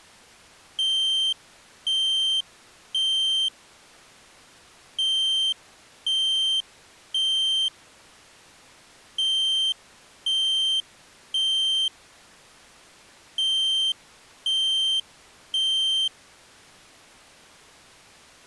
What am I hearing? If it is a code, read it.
Alarm pattern, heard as an alarm's beeps, played four times, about 3150 Hz. Temporal three. Smoke or fire, evacuate.